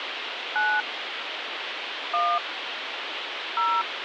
DTMF, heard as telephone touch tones, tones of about 250 ms, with phone line noise. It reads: 9 1 0